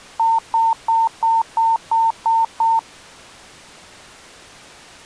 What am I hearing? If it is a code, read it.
Beep code, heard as beeps, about 910 Hz. 8 short. In AMI BIOS tables: display memory failure; in Dell tables: LCD failure.